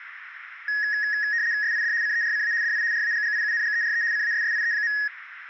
RTTY (75 baud, 170 Hz shift), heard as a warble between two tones, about 1800 Hz centre, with radio static. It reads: SID CERCA DI RAGGIUNGERE CASSIE.